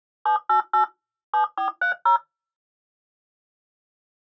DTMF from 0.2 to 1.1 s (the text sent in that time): 788